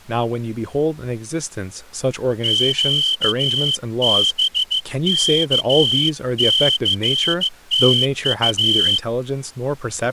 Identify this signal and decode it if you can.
Morse code, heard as a whistle, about 14 wpm, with speech in English. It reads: QBKCTU